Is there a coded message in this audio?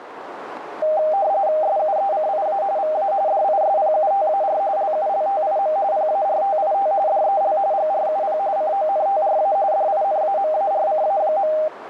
Yes: RTTY (45.45 baud, 170 Hz shift) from 0.8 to 11.7 s, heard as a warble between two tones, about 710 Hz centre, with radio static and a narrow filter. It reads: SUECIA VA DISPUTAR LULTIM PARTIT DEL GRUP CONTRA DINAMARCA.